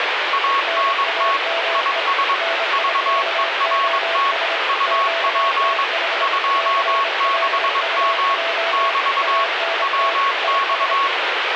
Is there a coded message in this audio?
Yes: Morse code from 0.3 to 11.1 s, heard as two keyed tones, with radio static. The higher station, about 22 wpm, 1100 Hz: ANT IS VERT UP 26M <BT> WX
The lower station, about 26 wpm, 670 Hz: NAME NIKOS QTH CLUJ ANT IS